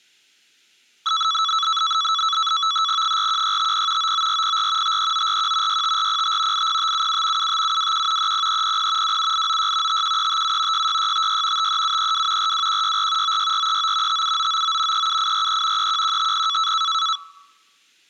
NAVTEX (SITOR-B), 100 baud, 170 Hz shift, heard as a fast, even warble, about 1220 Hz centre. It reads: 41650 99404 53941 65405 80577 75721 30300 27896 51357 66656 53732 42164 96439 57999 37843 31150